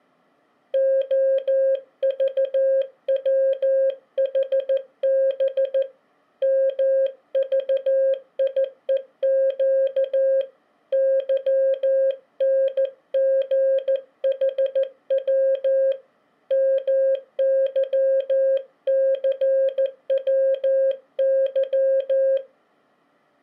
Morse code, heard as a keyed tone, hand-sent with a paddle, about 14 wpm, 540 Hz. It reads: OVWHB MVIEQ YNGHW MYCWY